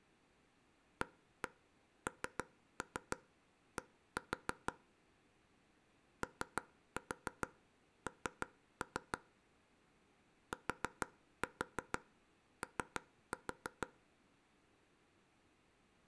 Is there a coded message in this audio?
Yes: tap code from 1.0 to 13.9 s, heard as taps on a table, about 6 knocks a second. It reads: AND ON TO